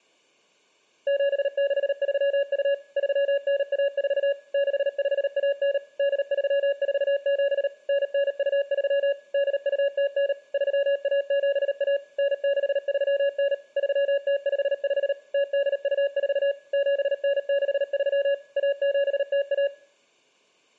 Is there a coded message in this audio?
Yes: Morse code (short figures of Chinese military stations) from 1.0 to 19.7 s, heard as a keyed tone, machine-sent, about 38 wpm, 560 Hz, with room echo. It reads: 7632 3914 6519 8347 9923 8209 3171 9639 3055 0824 7963 1701